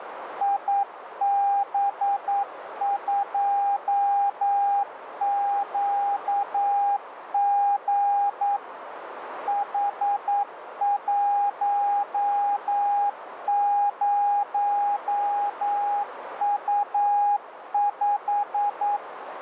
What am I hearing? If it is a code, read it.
Morse code, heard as a keyed tone, machine-sent, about 9 wpm, 810 Hz, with radio static and a narrow filter. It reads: IB2QG H10U5